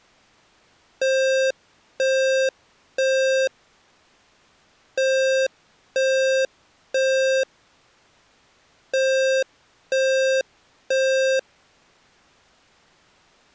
Alarm pattern, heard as an alarm's beeps, played three times, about 530 Hz. Temporal three. Smoke or fire, evacuate.